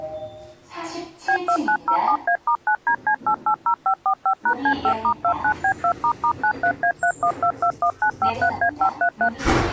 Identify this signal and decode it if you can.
DTMF, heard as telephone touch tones, dialled by machine, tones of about 80 ms, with the noise inside a lift. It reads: B2907A*9DC880545#C5*29B2**93A31221953A533